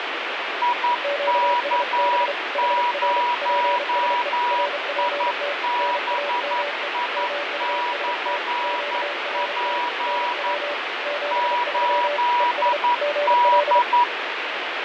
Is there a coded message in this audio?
Yes: Morse code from 0.6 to 14.1 s, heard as two keyed tones, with heavy radio static and fading. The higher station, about 11 wpm, 970 Hz: IK0IBI/P 8D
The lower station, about 32 wpm, 580 Hz: QSB HR PSE RPT NAME MUST QRT NW 73 ES GL